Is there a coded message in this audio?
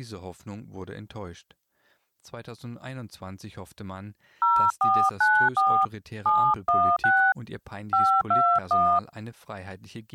Yes: DTMF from 4.4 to 9.0 s, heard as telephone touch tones, dialled by hand, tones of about 280 ms. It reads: 0494 716 521